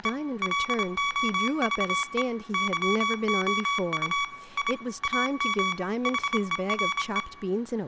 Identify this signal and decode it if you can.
Morse code, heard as electronic beeps, machine-sent, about 26 wpm, 1130 Hz, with room echo and speech in English. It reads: … LOVE YOU I AM HERE